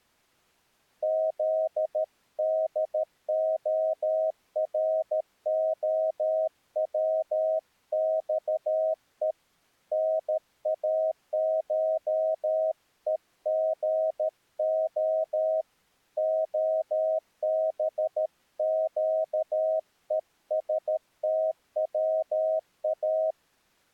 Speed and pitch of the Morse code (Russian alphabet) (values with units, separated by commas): 13 wpm, 640 Hz